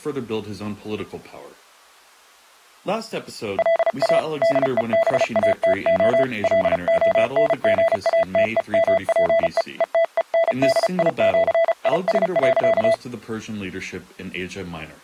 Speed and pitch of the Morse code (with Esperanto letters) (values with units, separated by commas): 34 wpm, 660 Hz